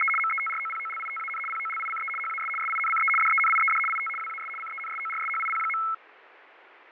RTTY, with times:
0.0-0.1 …
0.2-1.4 METROPOLITAN
1.5-2.1 POLICE
2.2-2.5 HAS
2.6-3.1 SINCE
3.2-3.8 DENIED
3.9-4.1 IT
4.2-4.5 WAS
4.6-5.8 CENSORSHIP.

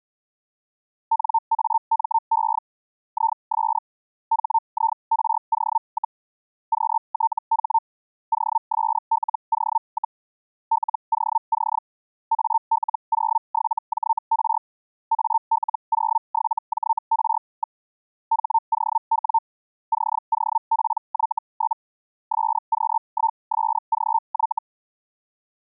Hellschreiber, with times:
1.1-2.6 NAME
3.1-3.8 IS
4.3-6.2 HIRO,
6.7-7.8 QTH
8.3-10.2 OSLO,
10.7-11.8 LOC
12.3-14.6 AL07JR
15.1-17.8 AL07JR.
18.3-19.4 HOW
19.9-21.8 COPY?
22.3-24.6 SQ1SGY

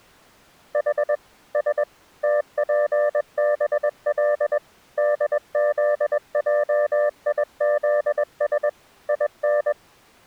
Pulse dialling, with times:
none

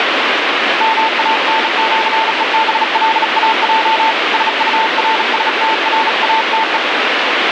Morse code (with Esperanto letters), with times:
0.8-4.1 MANĜEBLAJ
4.3-6.8 SURSTRATE

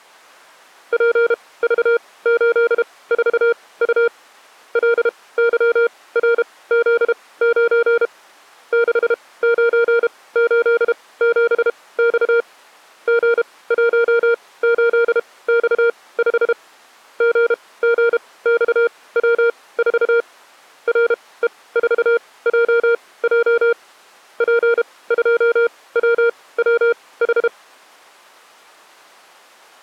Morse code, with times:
0.9-4.1 PV84U
4.8-8.1 LYRZ9
8.7-12.4 6987X
13.1-16.5 G18X5
17.2-20.2 GGXW4
20.9-23.7 RE4JJ
24.4-27.5 P2WWH

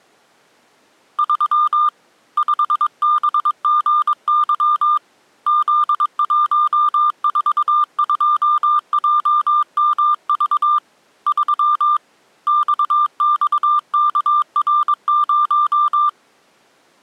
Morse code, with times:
1.2-1.9 3
2.4-5.0 5BGY
5.5-10.8 Z142JMV
11.3-12.0 3
12.5-16.1 XXKR0

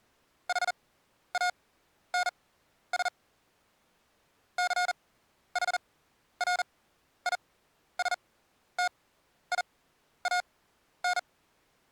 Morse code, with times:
0.5-3.1 HANS
4.6-11.2 CHRISTIAN

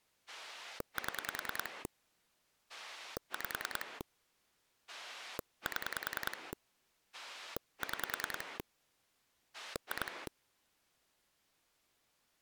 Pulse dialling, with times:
0.3-1.9 7
2.7-4.0 5
4.9-6.5 7
7.1-8.6 6
9.5-10.3 2

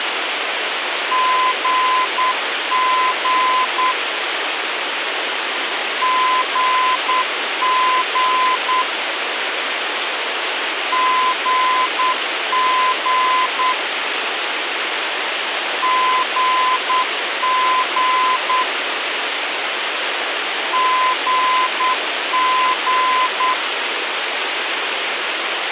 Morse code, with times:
1.1-3.9 GG
6.0-8.8 GG
10.9-13.7 GG
15.8-18.6 GG
20.7-23.5 GG

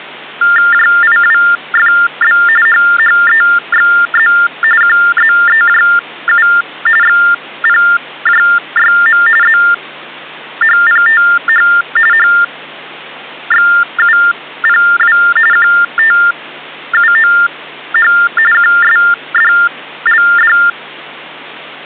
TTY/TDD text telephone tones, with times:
0.7-2.4 JIWFB
2.7-4.3 HHEXZ
4.8-6.5 QZEJU
7.0-9.2 XPJYM
9.4-11.7 ZHPTH
12.1-15.2 HXUPW
15.5-18.1 QTUOH
18.5-20.6 QSDLD

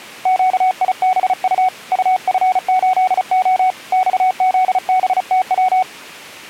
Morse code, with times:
0.3-1.7 QIBU
1.9-3.7 UF8O
3.9-5.8 XZBTW

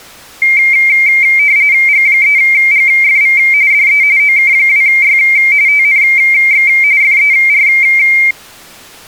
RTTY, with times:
1.9-3.4 G3GFV
3.7-4.0 DE
4.2-5.2 OK2Y
5.7-6.7 TNX
7.0-7.7 FER

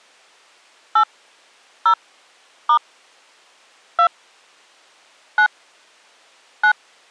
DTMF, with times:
1.0-1.0 8
1.9-1.9 0
2.7-2.8 *
4.0-4.1 2
5.4-5.5 9
6.6-6.7 9

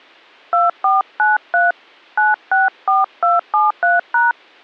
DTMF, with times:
0.5-1.7 2493
2.2-4.3 964273#

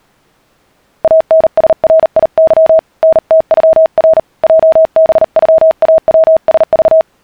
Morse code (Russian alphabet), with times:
1.0-2.8 АНСРИЫ
3.0-4.2 НТЮР
4.4-7.0 ЙБЮАВСЖ

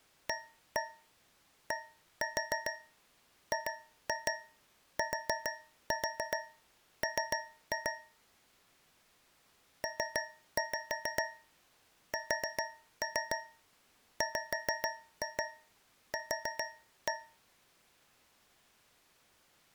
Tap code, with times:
0.3-7.9 ADGTM
9.8-17.1 PSWQ

